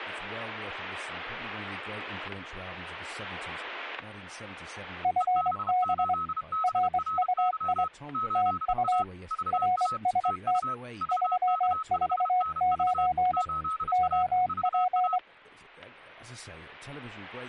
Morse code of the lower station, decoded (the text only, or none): FB RUI TU RST 349 OP